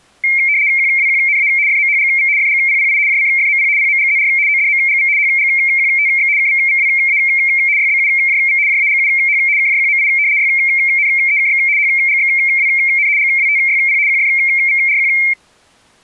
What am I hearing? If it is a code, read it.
RTTY (75 baud, 170 Hz shift), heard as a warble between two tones, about 2200 Hz centre. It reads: QWQNA FMHGV FGPPI JCFMP PMGZR ODMGV HGQTX KVVWA YBUJV JAGUH KJQMI YNEKX HGXWN GWTYP QFVRQ